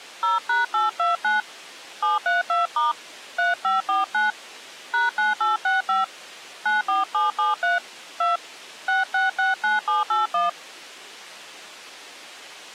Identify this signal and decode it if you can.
DTMF, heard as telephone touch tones, dialled by hand, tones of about 160 ms. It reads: 0#829 732* 3549 #9865 94773 2 6669781